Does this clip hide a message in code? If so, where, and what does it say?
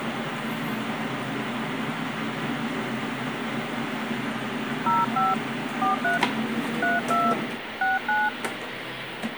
Yes: DTMF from 4.9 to 8.3 s, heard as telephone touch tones, dialled by hand, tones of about 180 ms, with radio hiss and kitchen noise. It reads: 05 43 32 69